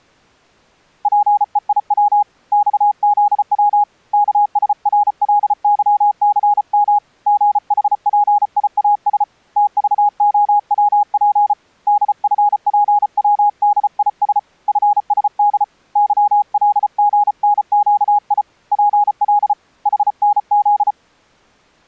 Morse code, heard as a keyed tone, hand-sent with a paddle, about 34 wpm, 830 Hz. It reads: PEIW XZW KSRLYCM GHPIAS TVOWP DFPWDIS FSD YLGNQI PL HNZ